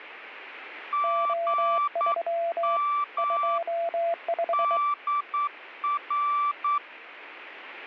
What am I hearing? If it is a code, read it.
Morse code, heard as two keyed tones. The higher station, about 9 wpm, 1160 Hz: GM DR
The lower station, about 23 wpm, 680 Hz: O3 25